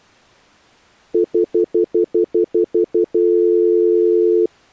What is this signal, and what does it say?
Telephone call progress tone (North American plan), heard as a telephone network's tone, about 350, 440 Hz, 0.1 s on and 0.1 s off. Stutter dial tone.